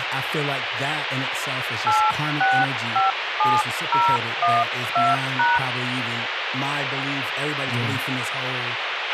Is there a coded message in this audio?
Yes: DTMF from 1.9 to 5.6 s, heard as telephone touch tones, dialled by hand, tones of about 190 ms, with radio hiss, a squelch burst at the end and speech in English. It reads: 8657012#